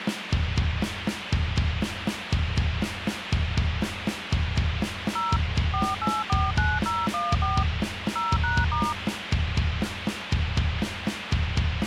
DTMF, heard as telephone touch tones, dialled by machine, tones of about 210 ms, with phone line noise. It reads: 0 4849014 0#*